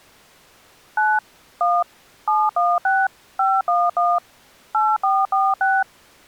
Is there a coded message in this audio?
Yes: DTMF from 1.0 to 5.8 s, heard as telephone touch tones, dialled by machine, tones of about 220 ms. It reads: 9 1 716 511 8446